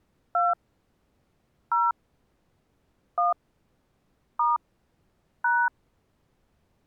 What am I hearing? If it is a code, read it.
DTMF, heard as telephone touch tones, dialled by hand, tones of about 180 ms. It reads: 2 0 1 * #